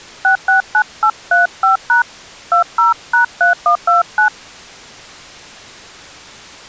DTMF, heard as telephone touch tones, dialled by hand, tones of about 110 ms. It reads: 669835# 20#3129